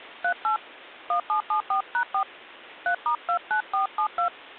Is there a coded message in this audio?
Yes: DTMF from 0.2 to 4.3 s, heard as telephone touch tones, dialled by hand, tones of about 100 ms. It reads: 38 1774#4 3*29472